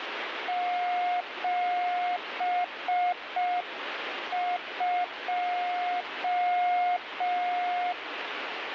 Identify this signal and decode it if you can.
Morse code, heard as a keyed tone, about 5 wpm, 720 Hz, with radio static. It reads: 72